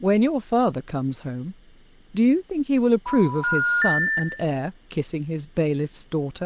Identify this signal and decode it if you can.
Telephone call progress tone (North American plan), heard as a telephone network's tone, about 980, 1430, 1800 Hz, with room echo and speech in English. Special information tone.